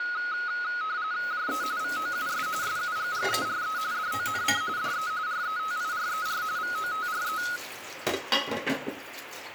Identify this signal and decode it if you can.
RTTY (45.45 baud, 170 Hz shift), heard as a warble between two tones, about 1360 Hz centre, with radio static and kitchen noise. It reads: JE VOUS SUGGERE DONC DE RETIRER VOTRE